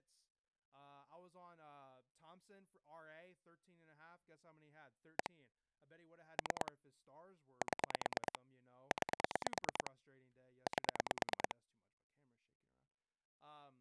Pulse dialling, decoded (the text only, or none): 1 3 7 9 8